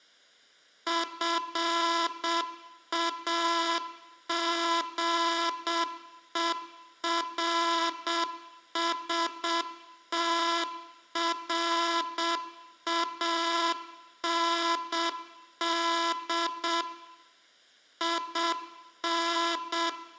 Morse code, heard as a buzzer, machine-sent, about 7 wpm, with room echo. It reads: FAGERSTRAND IN